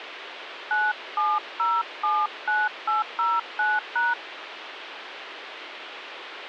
DTMF, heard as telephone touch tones, dialled by hand, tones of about 210 ms, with radio hiss. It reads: 97079809#